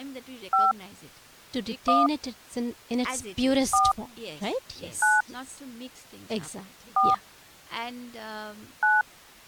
DTMF, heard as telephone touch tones, dialled by hand, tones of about 180 ms, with speech in English. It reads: 5 1 4 9 4 9